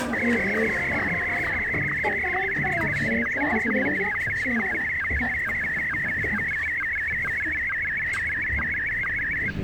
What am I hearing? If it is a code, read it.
SSTV (slow-scan television), Martin M1, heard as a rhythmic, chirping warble, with radio static and the noise inside a lift.